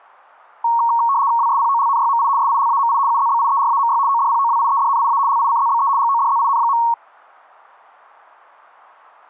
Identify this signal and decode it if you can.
RTTY (75 baud, 170 Hz shift), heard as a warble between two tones, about 1020 Hz centre. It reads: WSPOLNYMI SILAMI UZBIERAMY ODPOWIEDNIA LICZBE GODZIN.